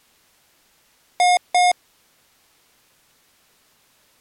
Beep code, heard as beeps from a small speaker, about 720 Hz. 2 short. In AMI BIOS tables: memory parity error; in IBM BIOS tables: self-test error shown on screen; in Dell tables: no memory detected.